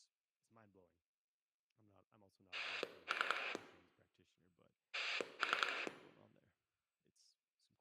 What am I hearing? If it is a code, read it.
Pulse dialling, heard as a rotary dial, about 10 pulses a second, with room echo and speech in English. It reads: 3 3